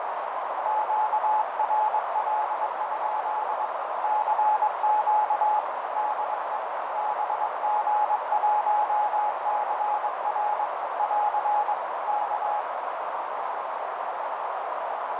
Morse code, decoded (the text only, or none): QRL? CQ DE BG1CR <AR> K